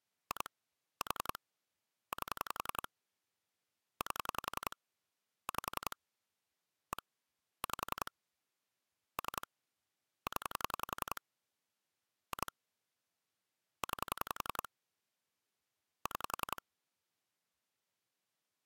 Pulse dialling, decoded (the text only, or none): 2 4 8 8 5 1 5 3 0 2 9 6